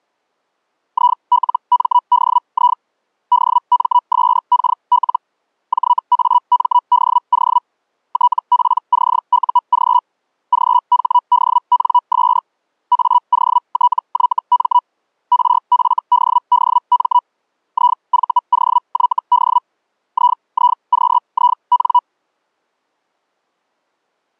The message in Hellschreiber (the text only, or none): ILMDI DMSKL JAMDO TPCUG GHDNS AOTYM RFDDM IVOYD IIQIN